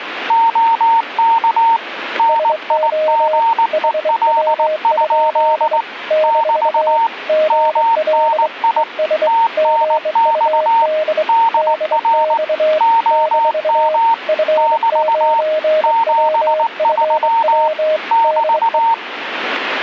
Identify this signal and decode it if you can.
Morse code, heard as two keyed tones. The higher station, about 19 wpm, 910 Hz: OK NIGEL? <BT> MNI TNX DR OM <BT> 73 <BT>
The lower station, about 24 wpm, 620 Hz: SO HW? - GL ES GUD DX - F9WFW DE